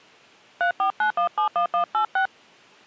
DTMF, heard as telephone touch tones, dialled by hand, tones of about 100 ms. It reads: 349171186